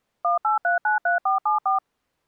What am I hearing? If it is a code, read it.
DTMF, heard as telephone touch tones, dialled by machine, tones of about 130 ms. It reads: 18393474